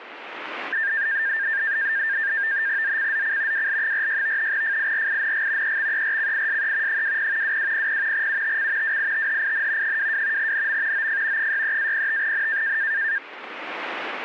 NAVTEX (SITOR-B), 100 baud, 170 Hz shift, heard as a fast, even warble, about 1700 Hz centre. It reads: ZCZC WL46 FIRING EXERCISE 20 2200 UTC WITHIN 22 NM OF 63-05N